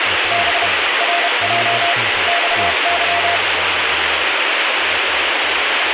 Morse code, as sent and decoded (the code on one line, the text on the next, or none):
-... / .-. .--- / -..- -.--
B RJ XY